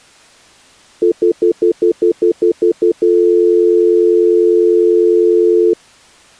Telephone call progress tone (North American plan), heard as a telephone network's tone, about 350, 440 Hz, 0.1 s on and 0.1 s off. Stutter dial tone.